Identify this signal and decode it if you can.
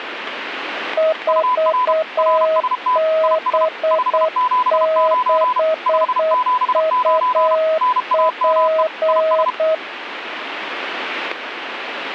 Morse code, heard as two keyed tones, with radio static. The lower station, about 8 wpm, 640 Hz: 4B6UP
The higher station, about 32 wpm, 1000 Hz: UR RST IS 579 579 NAME IS